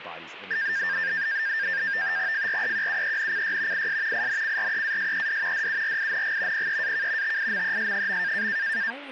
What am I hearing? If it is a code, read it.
NAVTEX (SITOR-B), 100 baud, 170 Hz shift, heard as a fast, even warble, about 1700 Hz centre, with radio static and speech in English. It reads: FREQUENCY IS INCREASED DURING PEAK TIMES.